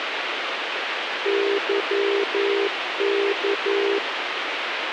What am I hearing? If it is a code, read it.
Morse code, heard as a keyed tone, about 11 wpm, 400 Hz, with radio hiss. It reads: YK